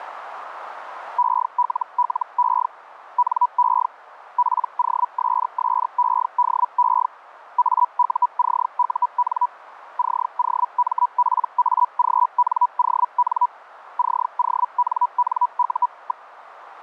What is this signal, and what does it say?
Hellschreiber (Feld-Hell, 122.5 baud), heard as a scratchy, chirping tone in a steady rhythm, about 980 Hz, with radio static. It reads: ELLE NE POSSEDE AUCUN COMPAGNON CONNU.